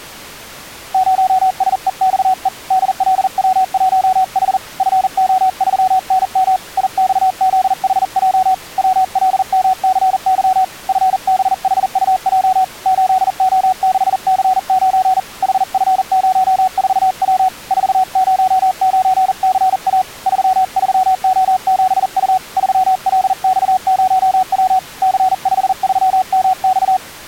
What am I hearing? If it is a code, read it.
Morse code, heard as a keyed tone, hand-sent with a paddle, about 40 wpm, 740 Hz. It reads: 0SEXE DLW1H FO3NM IXZHJ WLMCY FBHUJ 8O6C9 HF04W 409CA 33O7U 3LX0W C53MX